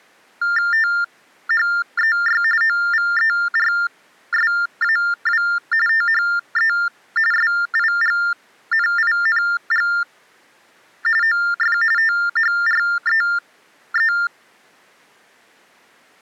TTY/TDD text telephone tones (45.45 baud Baudot), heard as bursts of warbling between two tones, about 400 Hz shift, 1600 Hz centre. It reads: THEY OVERSAW THE SIGNING OF THREE